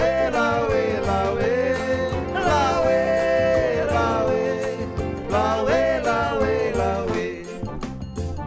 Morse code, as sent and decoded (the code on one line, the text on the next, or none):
none